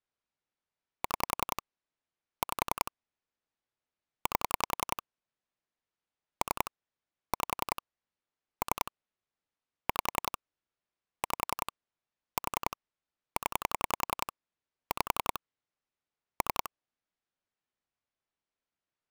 Pulse dialling, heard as clicks on a phone line, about 10 pulses a second. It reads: 6 5 8 3 5 3 5 5 4 0 5 3